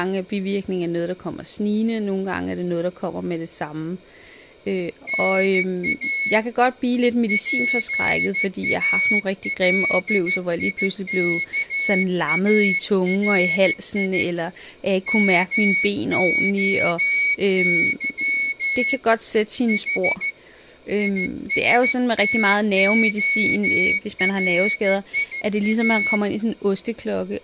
Morse code (Greek alphabet), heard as a whistle, hand-sent with a straight key, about 14 wpm, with speech in Danish. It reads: ΝΑ ΠΑΛΙΚΑΡΙ ΜΟΥ Η ΙΣΤΟΡΙΑ